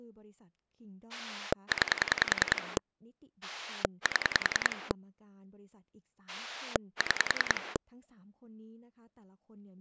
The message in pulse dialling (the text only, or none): 9 7 6